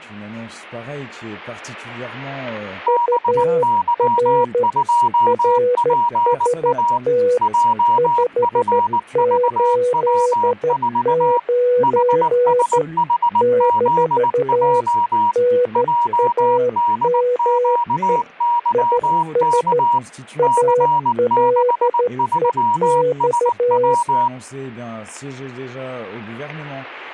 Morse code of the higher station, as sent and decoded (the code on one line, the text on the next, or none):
-... -.-- ..--- .--. .- / .--- ..-. ...- .-- ....- / .... ... .... --.. .--- / .--- -.. --.- -.-- -.- / -.-. -.... ...-- ... .--
BY2PA JFVW4 HSHZJ JDQYK C63SW